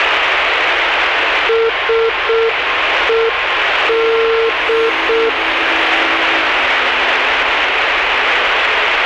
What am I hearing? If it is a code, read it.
Morse code, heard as a keyed tone, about 6 wpm, 450 Hz, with radio static. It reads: SED